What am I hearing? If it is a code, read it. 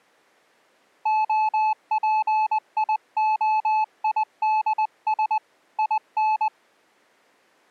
Morse code, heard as a keyed tone, hand-sent with a paddle, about 20 wpm, 860 Hz. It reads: OPIOIDS IN